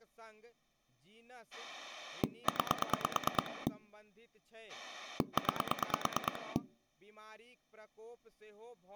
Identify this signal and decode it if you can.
Pulse dialling, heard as a rotary dial, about 9 pulses a second, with speech in Maithili. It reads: 9 9